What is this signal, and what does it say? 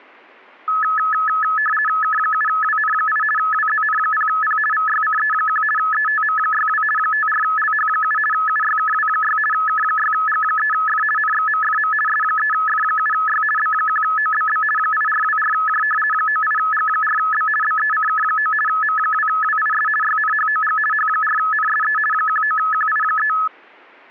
RTTY (50 baud, 450 Hz shift), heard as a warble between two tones, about 1500 Hz centre. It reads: K7WN8 WZN0P VYCE1 ETM62 54LH7 UYKW6 K6G3F NXMFM S3F7Y B1OBB 8424J 98G4B BECK9 M2WIS YNHOG H4NSE 19QI3